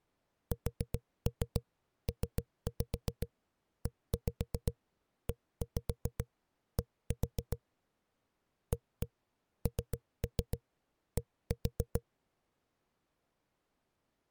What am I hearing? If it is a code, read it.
Tap code, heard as knocks on a wall, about 7 knocks a second. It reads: SPEED AND